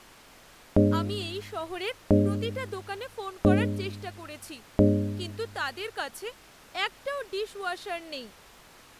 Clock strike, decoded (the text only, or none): 4